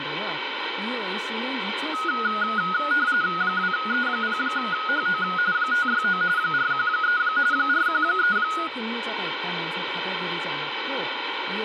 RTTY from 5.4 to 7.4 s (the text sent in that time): 569 413